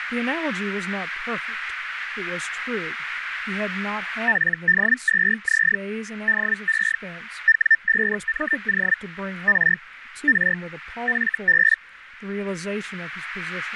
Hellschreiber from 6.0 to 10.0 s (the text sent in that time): DE W5MO R